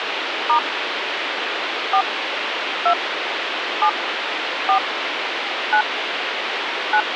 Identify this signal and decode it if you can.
DTMF, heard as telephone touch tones, dialled by hand, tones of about 90 ms, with phone line noise. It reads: * 4 2 7 4 9 9